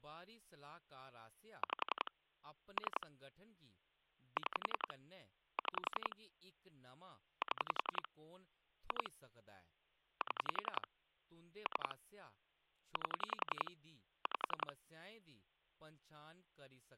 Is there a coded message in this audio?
Yes: pulse dialling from 1.6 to 14.7 s, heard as clicks on a phone line, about 11 pulses a second, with speech in Dogri. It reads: 5 3 6 6 7 2 7 3 8 5